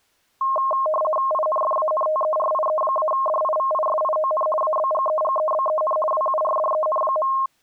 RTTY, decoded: INFANTERIE-DIVISION ABGEGEBEN WURDEN.

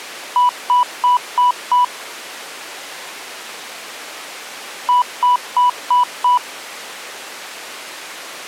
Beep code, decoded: 5 short

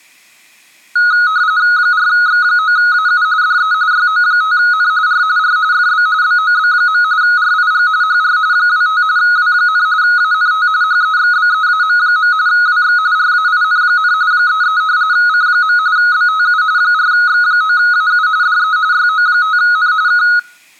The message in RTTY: 4X9AU DE YO5N R R FB BOB. RIG HR 25 W, ANT HEXBEAM. WX RAIN, 33 C. BTU 4X9AU DE YO5N K

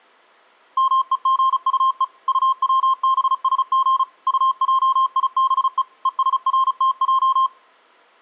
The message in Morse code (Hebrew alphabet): מוגטו טצבשג טעיבו ושרתע

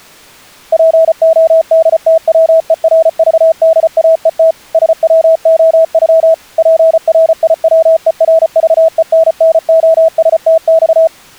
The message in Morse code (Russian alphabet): ПОДТВЕРЖДАЕТ СВОЮ ПРИВЕРЖЕННОСТЬ

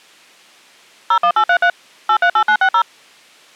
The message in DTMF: 01833 838960

